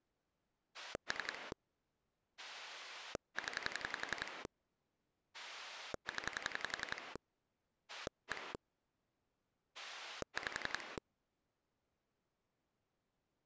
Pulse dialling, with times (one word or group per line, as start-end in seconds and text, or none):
0.7-1.5 3
2.4-4.5 0
5.3-7.2 0
7.9-8.5 1
9.7-11.0 5